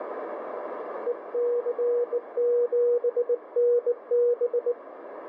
Morse code, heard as a keyed tone, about 19 wpm, 480 Hz, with radio static and a narrow filter. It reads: EC7NB